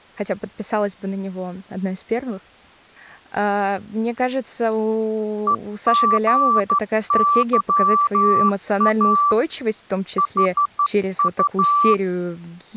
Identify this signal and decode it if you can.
Morse code, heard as a keyed tone, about 13 wpm, 1160 Hz, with speech in Russian. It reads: EGYA HU